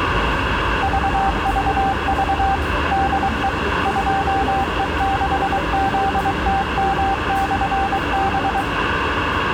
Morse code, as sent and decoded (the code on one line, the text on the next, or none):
...- ...- ...- / -.. . / ..--- . -.... --.. - -- -..-. -...
VVV DE 2E6ZTM/B